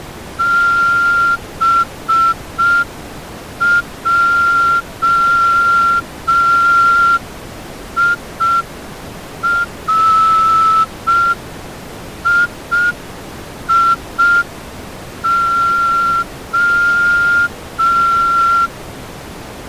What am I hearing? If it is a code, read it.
Morse code (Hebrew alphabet), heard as a whistle, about 5 wpm. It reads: בעירייה